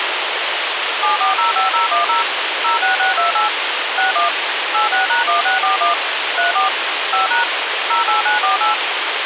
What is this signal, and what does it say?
DTMF, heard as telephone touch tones, dialled by machine, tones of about 140 ms, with radio hiss. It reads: 7405010 06628 61 86#1641 34 5# 08948